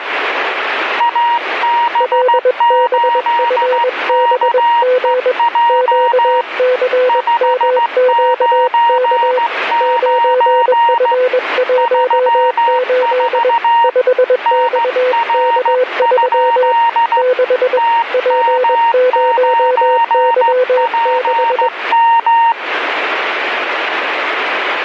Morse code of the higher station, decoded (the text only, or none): AB8KEJ 599 34 NR? TM9PM